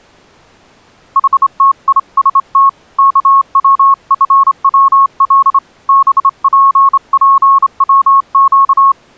Morse code, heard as a keyed tone, hand-sent with a straight key, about 27 wpm, 1100 Hz. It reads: HTIST KWFWL BPPWQ